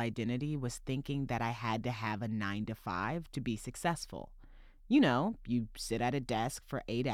Speech in English. There is no code.